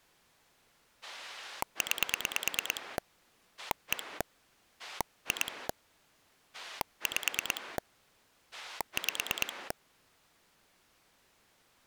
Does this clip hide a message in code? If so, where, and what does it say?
Yes: pulse dialling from 1.0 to 9.7 s, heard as a rotary dial, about 9 pulses a second. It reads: 9 1 2 5 5